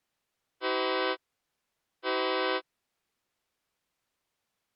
Train horn signal, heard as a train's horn. 2 short. On North American railways: a signal is acknowledged.